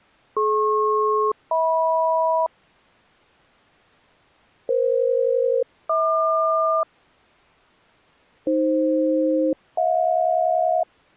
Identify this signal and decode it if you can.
Aircraft SELCAL, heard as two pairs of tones. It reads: DP-HM EF-HQ AF-HJ